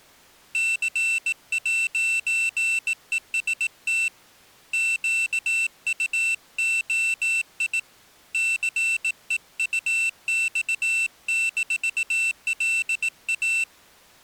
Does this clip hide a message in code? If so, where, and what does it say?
Yes: Morse code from 0.5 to 13.7 s, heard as a high beeper, hand-sent with a bug key, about 18 wpm, 2700 Hz. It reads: C'EST QUOI CEUX-LA